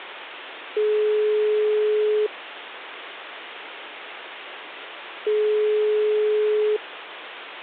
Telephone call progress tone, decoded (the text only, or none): ringback tone